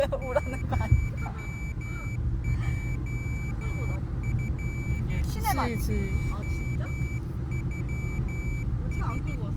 Morse code (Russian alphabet), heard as a high beeper, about 13 wpm, 2300 Hz, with the noise inside a car. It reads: ЪЙФШЮС